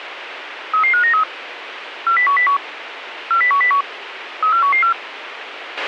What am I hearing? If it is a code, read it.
Five-tone selective call (CCIR), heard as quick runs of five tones, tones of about 100 ms, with radio hiss and a squelch burst at the end. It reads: 33593 40101 40101 34114